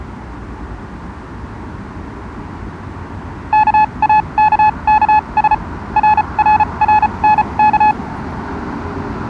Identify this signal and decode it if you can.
Morse code, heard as a keyed tone, machine-sent, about 34 wpm, spaced as for 27 wpm, 850 Hz, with street noise. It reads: KAKKS RRRNK